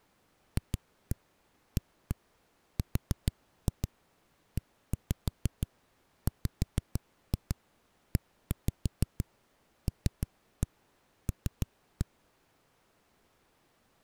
Tap code, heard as knocks on a wall, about 6 knocks a second. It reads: FAREWELL